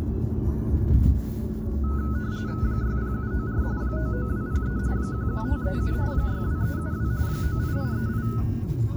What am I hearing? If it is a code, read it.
RTTY (45.45 baud, 170 Hz shift), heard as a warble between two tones, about 1380 Hz centre, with the noise inside a car. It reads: 60794 99203 11537 62372 98838